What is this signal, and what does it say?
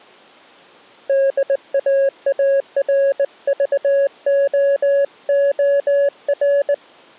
Morse code, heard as a keyed tone, hand-sent with a straight key, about 19 wpm, 560 Hz. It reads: DAARVOOR